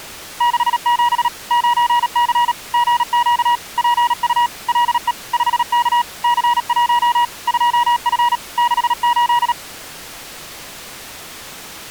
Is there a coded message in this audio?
Yes: Morse code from 0.3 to 9.6 s, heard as a keyed tone, machine-sent, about 37 wpm, 960 Hz. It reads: 67 9C GQ PU LE 5K C1 2F 68